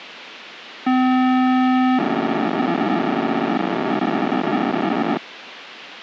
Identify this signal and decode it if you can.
POCSAG pager data (512 baud), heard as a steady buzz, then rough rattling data, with radio hiss.